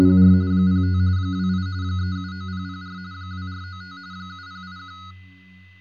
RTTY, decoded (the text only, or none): … 05 28 379004 2495 7081